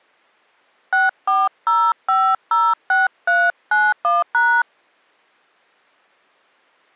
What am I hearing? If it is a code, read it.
DTMF, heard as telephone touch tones, dialled by hand, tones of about 240 ms. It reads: 640506391#